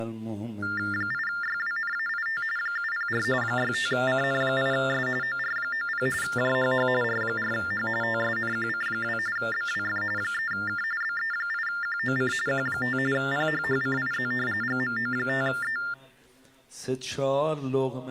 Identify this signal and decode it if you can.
TTY/TDD text telephone tones (45.45 baud Baudot), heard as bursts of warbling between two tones, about 400 Hz shift, 1600 Hz centre. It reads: 8YWNAIT 704 65CN8S OR90 JHH R4H TSNQC2 BWF 3K BE8QOC Q5 PHHCIZ GMO5E